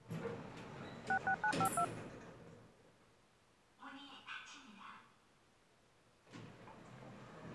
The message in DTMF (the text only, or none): 66952